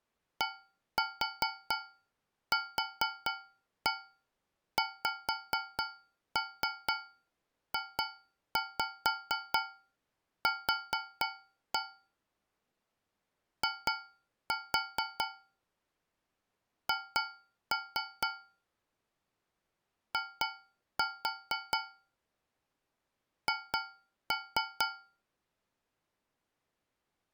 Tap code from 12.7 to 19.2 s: I H

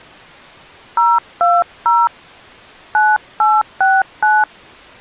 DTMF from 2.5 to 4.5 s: 9869

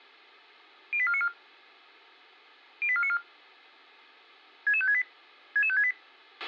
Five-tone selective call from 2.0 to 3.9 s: 08494

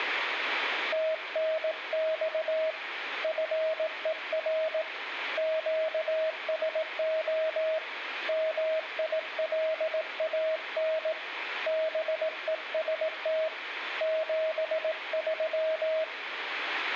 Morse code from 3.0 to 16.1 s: FER QSO MILAN BEST 73

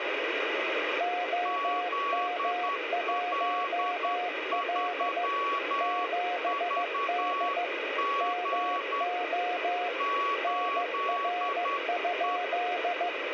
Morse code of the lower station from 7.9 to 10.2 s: MO

